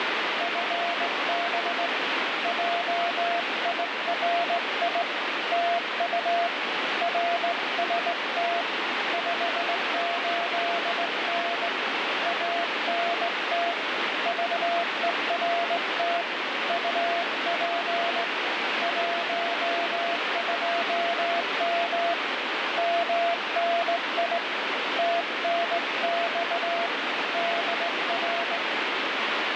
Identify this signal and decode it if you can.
Morse code, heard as a keyed tone, hand-sent with a straight key, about 18 wpm, 690 Hz, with heavy radio static. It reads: FB JIRI TU RST 58N ANT VERT UP 12M MNI TNX DR